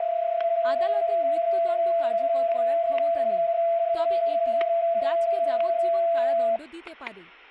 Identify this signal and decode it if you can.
PSK31 (31.25 baud), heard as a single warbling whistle, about 670 Hz, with static crashes and speech in Bangla.